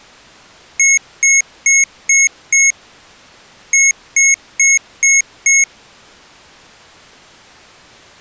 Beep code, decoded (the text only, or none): 5-5